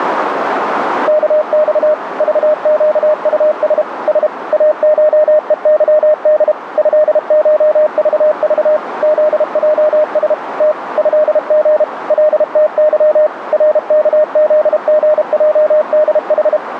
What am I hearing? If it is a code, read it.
Morse code (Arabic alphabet), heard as a keyed tone, machine-sent, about 32 wpm, 610 Hz, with radio static and a narrow filter. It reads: كص ضقطس س اشءظد هشضض ذجس ت هغ لتظ ركذغجدح